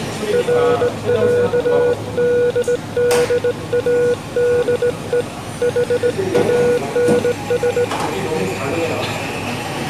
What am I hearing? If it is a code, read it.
Morse code (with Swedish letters), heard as a keyed tone, hand-sent with a straight key, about 18 wpm, 480 Hz, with the noise of a cafe. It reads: RÄDDADE HANS